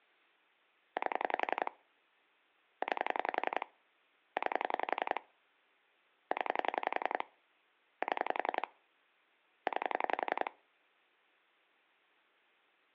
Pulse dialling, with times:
1.0-1.7 8
2.8-3.7 9
4.4-5.2 9
6.3-7.2 0
8.0-8.7 7
9.7-10.5 9

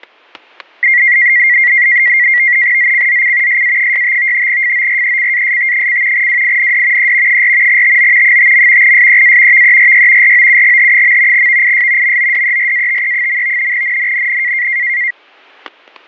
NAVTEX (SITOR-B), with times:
2.8-3.6 ZCZC
3.5-4.5 SA65
4.5-6.3 FORECAST:
6.1-7.1 WIND
7.0-7.4 E
7.3-7.8 4
7.7-8.4 TO
8.2-8.9 5.
8.8-9.6 SEA
9.5-10.3 VERY
10.2-11.5 ROUGH.
11.3-12.2 VIS
12.0-13.7 MODERATE.
13.7-14.7 NNNN

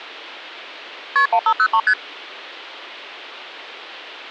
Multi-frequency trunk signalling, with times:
1.2-1.3 KP
1.3-1.8 1503
1.9-1.9 ST

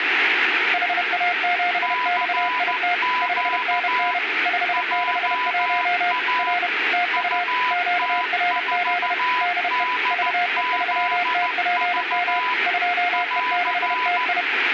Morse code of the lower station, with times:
0.7-2.9 HA7XIT
3.2-4.2 5NN
4.5-6.1 561
6.4-6.7 R
6.9-7.4 TU
7.7-9.1 QRZ
9.4-9.8 DE
10.1-12.4 VE3TPM
12.7-14.4 2E6TI

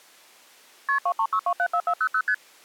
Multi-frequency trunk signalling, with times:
0.9-1.0 KP
1.1-2.2 236274400
2.3-2.3 ST

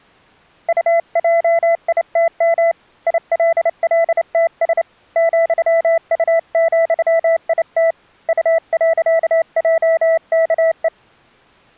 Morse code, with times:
0.7-2.7 UJITM
3.1-4.8 ILLTS
5.2-7.9 ,U,IT
8.3-10.9 U.JKE

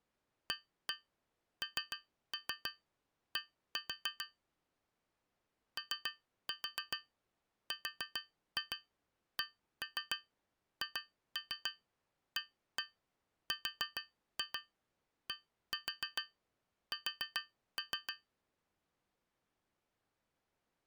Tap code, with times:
0.5-4.3 AND
5.8-18.1 ORCHARDS

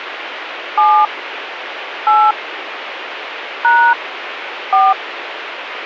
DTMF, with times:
0.8-1.1 7
2.1-2.3 8
3.6-3.9 #
4.7-4.9 4

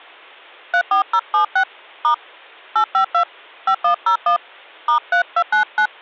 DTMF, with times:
0.7-1.6 34076
2.0-2.1 *
2.8-3.2 852
3.7-4.4 5101
4.9-5.9 *3299

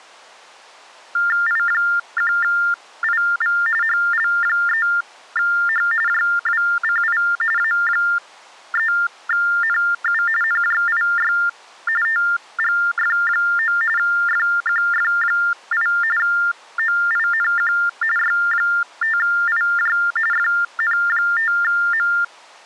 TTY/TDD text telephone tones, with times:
1.5-3.6 I1IV
3.8-5.9 HL3H
6.1-7.2 JWCI
7.6-10.2 A3NU
10.4-11.3 NJIY
12.0-13.8 TGF9
14.0-15.9 FQF8
16.2-17.7 OINQ
18.2-20.0 Y5IJ
20.3-22.1 FN5M

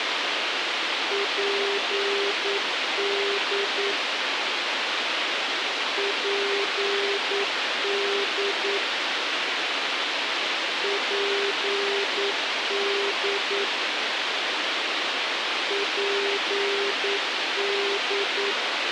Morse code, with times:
1.1-3.9 PD
6.0-8.8 PD
10.8-13.6 PD
15.7-18.5 PD

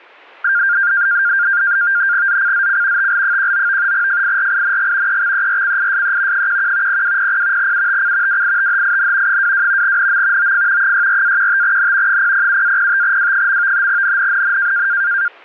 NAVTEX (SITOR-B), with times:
2.3-3.1 ZCZC
3.0-3.9 TL19
3.9-5.2 FIRING
5.1-6.5 EXERCISE
6.3-7.0 11
6.9-7.7 0200
7.6-8.4 UTC
8.3-9.4 WITHIN
9.3-10.0 22
9.8-10.5 NM
10.4-10.9 OF
10.8-12.2 64-15N
12.1-13.9 007-05W.
13.9-14.9 NNNN

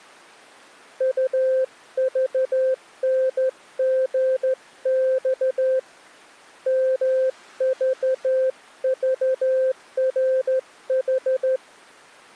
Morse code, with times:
1.0-5.8 UVNGX
6.7-11.6 MVVRH

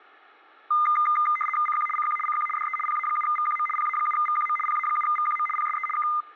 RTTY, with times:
1.7-1.9 CQ
2.0-2.2 CQ
2.3-2.5 CQ
2.6-2.8 DE
2.9-3.7 PA7VQM
3.8-4.6 PA7VQM
4.7-5.5 PA7VQM
5.6-5.9 PSE
6.0-6.1 K

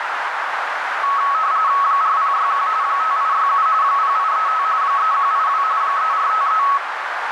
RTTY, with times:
1.8-2.7 4061
2.8-3.7 5867
3.8-4.6 0835
4.8-5.6 3182
5.8-6.6 3453

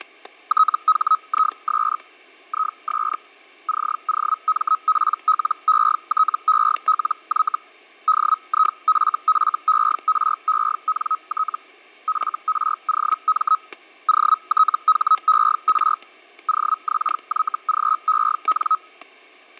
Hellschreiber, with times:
0.5-2.0 THIS
2.5-3.2 IS
3.7-7.6 COMPLETELY
8.1-11.6 DIFFERENT
12.1-13.6 FROM
14.1-16.0 OTHER
16.5-18.8 OXYGEN

